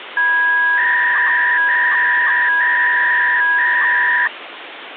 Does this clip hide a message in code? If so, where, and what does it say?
Yes: 300-baud modem data (V.21 tones) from 0.2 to 4.3 s, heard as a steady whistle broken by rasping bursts, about 300 baud, 200 Hz shift, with phone line noise.